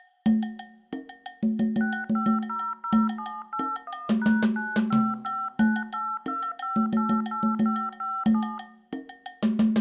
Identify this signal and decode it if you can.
DTMF, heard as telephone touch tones, dialled by machine, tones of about 240 ms, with room echo. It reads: 6500781#955982588557